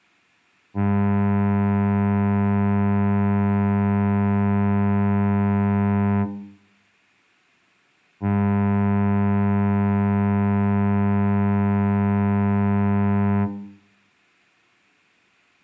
Ship horn signal, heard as a ship's horn, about 100 Hz, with room echo. 2 long. At sea: a vessel under power that has stopped in fog.